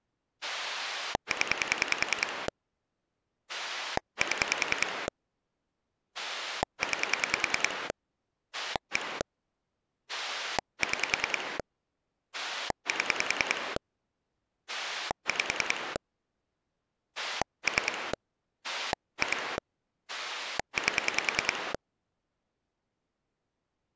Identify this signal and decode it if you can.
Pulse dialling, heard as a rotary dial, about 10 pulses a second. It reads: 0 7 9 1 6 7 5 3 2 8